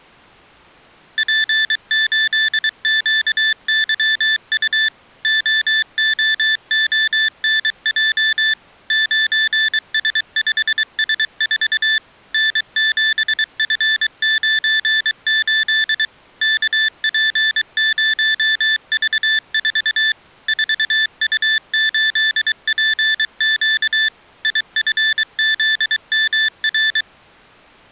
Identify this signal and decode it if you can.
Morse code, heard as electronic beeps, machine-sent, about 23 wpm, 1750 Hz. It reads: P8QYU OOONJ 9S5S4 N7F98 KP0V4 4U8PQ IFZMR